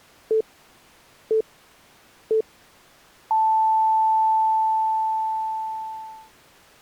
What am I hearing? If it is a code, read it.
Radio time signal (three low pips and a long one an octave up, as on NHK), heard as pips.